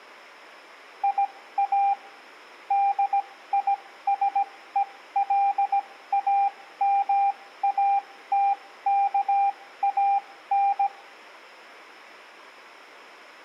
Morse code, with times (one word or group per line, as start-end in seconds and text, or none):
1.0-1.9 IA
2.7-10.9 DISELAMATKAN